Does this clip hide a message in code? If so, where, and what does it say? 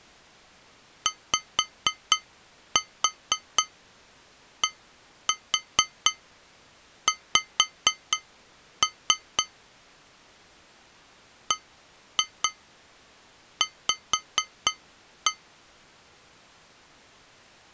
Yes: tap code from 1.1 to 15.4 s, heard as taps on glass, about 4 knocks a second. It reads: YDX BV